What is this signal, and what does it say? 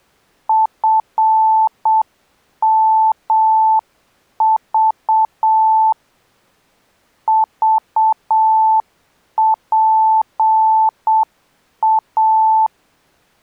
Morse code, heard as a keyed tone, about 7 wpm, 880 Hz. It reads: FMV VPA